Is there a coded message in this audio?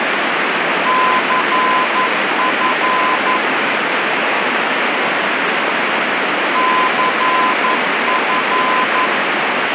Yes: Morse code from 0.8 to 9.1 s, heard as a keyed tone, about 11 wpm, 1020 Hz, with heavy radio static. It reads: CF CF